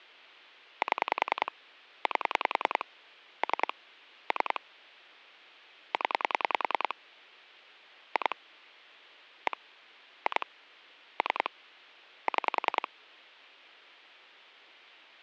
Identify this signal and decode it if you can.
Pulse dialling, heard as clicks on a phone line, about 10 pulses a second. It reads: 7 8 3 3 0 2 1 2 3 6